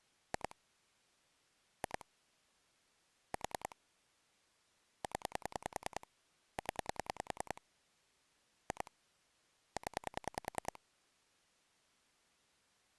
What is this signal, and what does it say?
Pulse dialling, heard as clicks on a phone line, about 10 pulses a second. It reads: 2 2 4 0 0 2 0